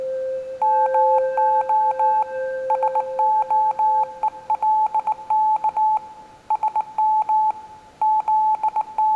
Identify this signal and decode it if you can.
Morse code (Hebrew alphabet), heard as a keyed tone, hand-sent with a bug key, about 19 wpm, 860 Hz, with room echo. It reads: מה שהולך שם …